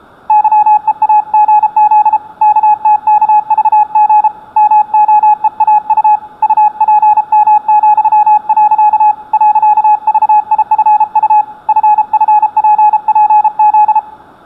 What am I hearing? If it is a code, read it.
Morse code, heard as a keyed tone, hand-sent with a paddle, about 33 wpm, 840 Hz. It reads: YEAGZ KTKVG MOEAU UPM,. .VIFU FFPPZ